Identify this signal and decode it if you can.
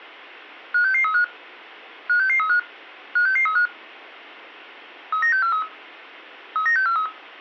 Five-tone selective call (CCIR), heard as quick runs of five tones, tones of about 100 ms. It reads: 56635 56635 56635 39643 39643